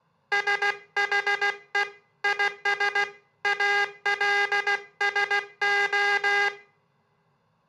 Morse code, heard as a buzzer, hand-sent with a paddle, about 16 wpm, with room echo. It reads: SHE IS ALSO